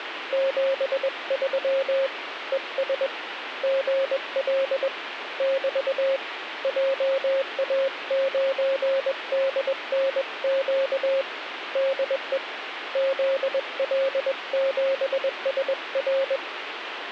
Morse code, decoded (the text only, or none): 73 ES GL <BT> JA9DNQ DE ZL7SR